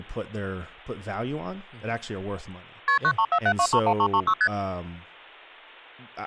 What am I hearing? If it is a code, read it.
Multi-frequency trunk signalling (R1, as on North American trunks), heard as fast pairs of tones, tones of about 70 ms, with speech in English. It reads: KP 9347231336 ST